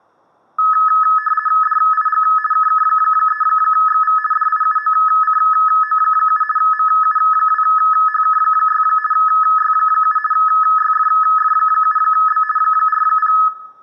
RTTY (50 baud, 450 Hz shift), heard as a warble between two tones, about 1500 Hz centre, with room echo. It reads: DIG KK3XV DIUOCO7 MU2HK6 Y7 YFF7B 40